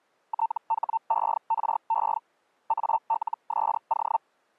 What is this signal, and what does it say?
Hellschreiber (Feld-Hell, 122.5 baud), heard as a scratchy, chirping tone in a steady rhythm, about 900 Hz. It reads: THERE ALSO